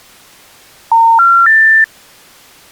Telephone call progress tone (North American plan), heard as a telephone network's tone, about 910, 1370, 1800 Hz. Special information tone.